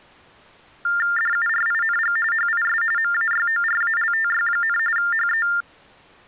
TTY/TDD text telephone tones (45.45 baud Baudot), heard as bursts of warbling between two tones, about 400 Hz shift, 1600 Hz centre. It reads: DURING HIS MAYORALTY, HE